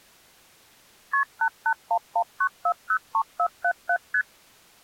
Multi-frequency trunk signalling (R1, as on North American trunks), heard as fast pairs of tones, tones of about 70 ms. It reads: KP 88119403477 ST